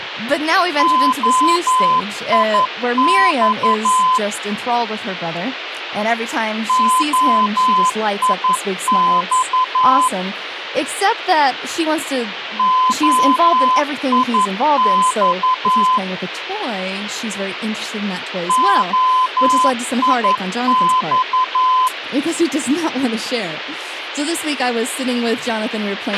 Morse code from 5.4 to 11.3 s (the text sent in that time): OIX